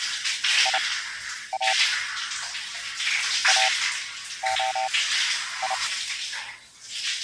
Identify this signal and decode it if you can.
Morse code (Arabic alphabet), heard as a keyed tone, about 30 wpm, spaced as for 10 wpm, 770 Hz, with the noise of a restroom. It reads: يا اخي